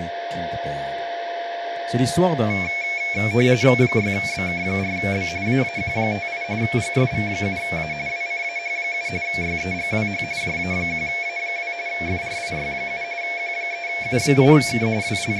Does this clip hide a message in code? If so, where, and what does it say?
Yes: RTTY (45.45 baud, 170 Hz shift) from 2.5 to 15.4 s, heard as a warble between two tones, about 2300 Hz centre, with radio static, a steady whistle near 690 Hz and speech in French. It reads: 6BK4B AAQ58 GSV7A WCAH7 YEGWH JA1A2 FRIY7 Q3U8K …